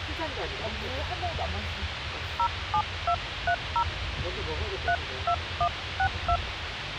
DTMF, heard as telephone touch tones, dialled by hand, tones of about 70 ms, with radio hiss and the noise inside a car. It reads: 07230 32162